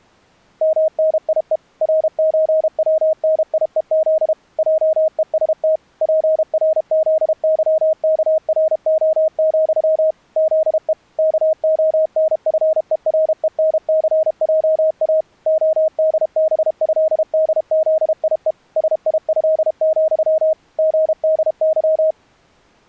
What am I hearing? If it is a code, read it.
Morse code (with Polish letters), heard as a keyed tone, machine-sent, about 32 wpm, 630 Hz. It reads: MNIE RÓWNIEZ JEST PRZYKRO, ZE KONFERENCJA ODBĘDZIE SIĘ, GDY